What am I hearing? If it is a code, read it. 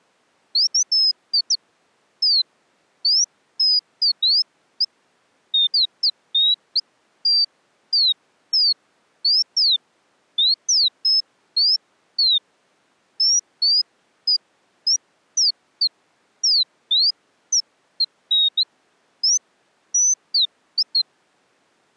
Bird-like chirps. There is no code.